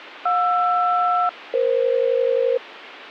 Aircraft SELCAL, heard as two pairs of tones, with radio hiss. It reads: JR-EF